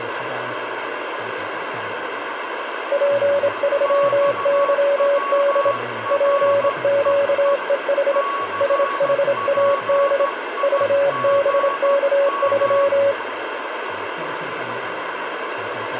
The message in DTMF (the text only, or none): none